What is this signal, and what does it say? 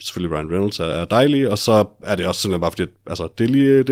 Speech in Danish. There is no code.